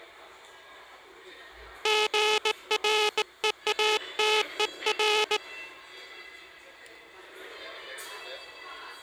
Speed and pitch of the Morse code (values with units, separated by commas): 18 wpm